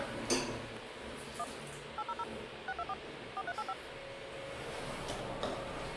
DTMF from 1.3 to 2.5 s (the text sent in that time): 1 800